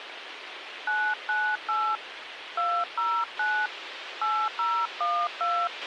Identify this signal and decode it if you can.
DTMF, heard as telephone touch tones, dialled by hand, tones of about 270 ms, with radio hiss and a squelch burst at the end. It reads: 998 209 8012